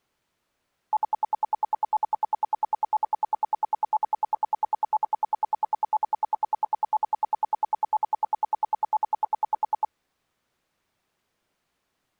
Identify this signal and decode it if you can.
Radio time signal (RWM, Moscow), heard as ten pulses a second.